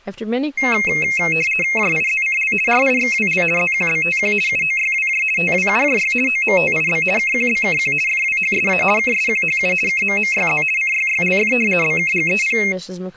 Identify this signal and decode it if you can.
RTTY (50 baud, 450 Hz shift), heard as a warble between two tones, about 2350 Hz centre, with speech in English. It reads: JIZCL RIXWL ZQBTQ UOYWJ TWUJY OMTIB KQBKQ FWHSA KSQHU KMMYZ CYYLF BKGEP